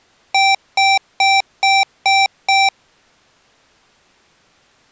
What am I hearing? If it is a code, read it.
Beep code, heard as beeps from a small speaker, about 780 Hz. 6 short. In AMI BIOS tables: keyboard controller gate A20 failure; in Dell tables: video card failure.